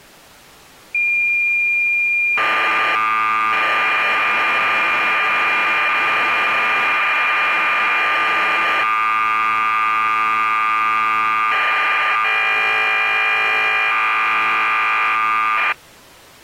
Cassette data (Kansas City type), 1200 baud, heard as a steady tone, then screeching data.